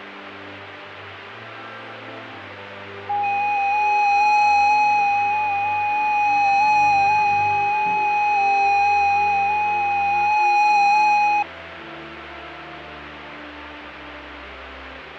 FT8 (several signals at once), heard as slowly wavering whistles, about 6.25 baud, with radio static and fading.